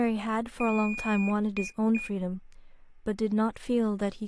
Beep code, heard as a piezo beeper, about 2450 Hz, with speech in English. 1 long, 2 short. In Award, IBM and AMI BIOS tables: video adapter failure.